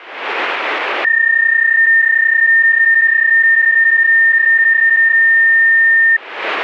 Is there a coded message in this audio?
Yes: PSK31 (31.25 baud) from 1.0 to 6.2 s, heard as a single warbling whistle, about 1800 Hz.